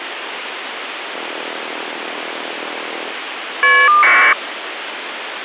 Caller ID data burst, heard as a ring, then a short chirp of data, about 1200 baud, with phone line noise.